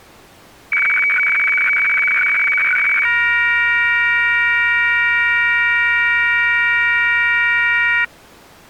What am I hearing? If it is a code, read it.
Weather fax (radiofax), 120 lines a minute, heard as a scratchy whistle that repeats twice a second.